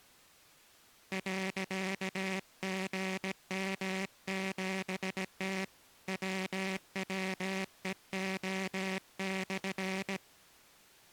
Morse code, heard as a buzzer, hand-sent with a paddle, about 17 wpm. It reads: .GM7T WWEO/